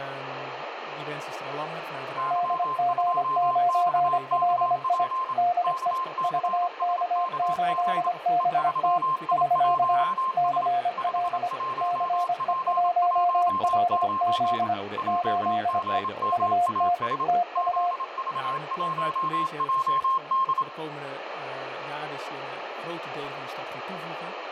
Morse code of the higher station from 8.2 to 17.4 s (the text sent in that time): E3I1S 51P19 JGMAS